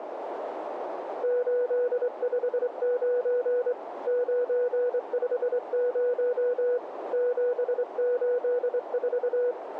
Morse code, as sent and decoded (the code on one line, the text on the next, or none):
---.. ..... ----. / ----. ..... ----- / --... ---.. ....-
859 950 784